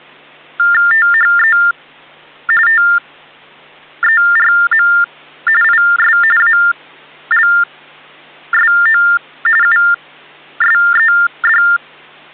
TTY/TDD text telephone tones (45.45 baud Baudot), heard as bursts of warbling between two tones, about 400 Hz shift, 1600 Hz centre. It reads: THE TERM IS ALSO USED